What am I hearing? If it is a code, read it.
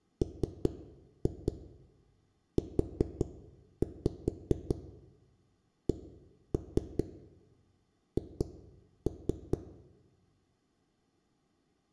Tap code, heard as knocks on a wall, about 4 knocks a second, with room echo. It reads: MUCH